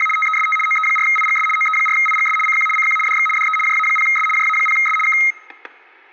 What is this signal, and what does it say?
RTTY (75 baud, 850 Hz shift), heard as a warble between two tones, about 1700 Hz centre, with static crashes and room echo. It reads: … TEST OE4IGS OE4IGS CQ CQ DX DE JA0S JA0S K